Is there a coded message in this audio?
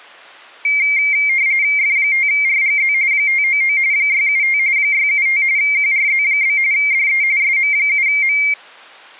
Yes: RTTY (45.45 baud, 170 Hz shift) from 0.6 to 8.5 s, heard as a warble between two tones, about 2200 Hz centre. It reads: F5RGZ 599 675 675 QRZ? DE SM7M